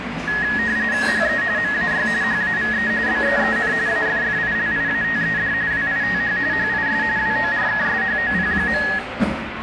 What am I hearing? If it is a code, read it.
RTTY (45.45 baud, 170 Hz shift), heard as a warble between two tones, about 1800 Hz centre, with radio static and the noise of a crowd indoors. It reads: HE MAY HAVE BEEN AFFILIATED WITH HIS WORKSHOP.